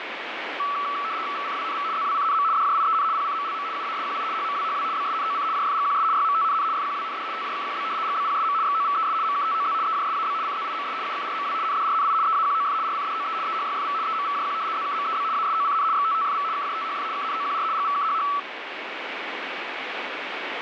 RTTY (75 baud, 170 Hz shift), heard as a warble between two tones, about 1230 Hz centre, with radio static. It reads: VCWNV ZWCNM DJIEN PCMLM UASQI HMWHW BSNOC JFGQS YMTNN FQWND TJKQB GBPSM XOVES MKTOZ EJSAB CZIMS UKRMW NDRNI EAQOF RCDOE EHYFV EMVJQ ZKMEB ASOCN XTTFV KJTHF KNOQR GVKHH